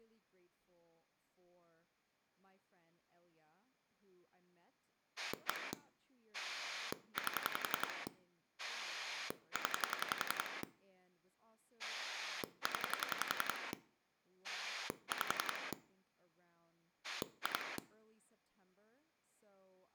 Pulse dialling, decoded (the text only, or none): 1 8 0 0 5 2